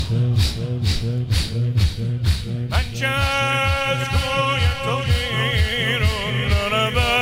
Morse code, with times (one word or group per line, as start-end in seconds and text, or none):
none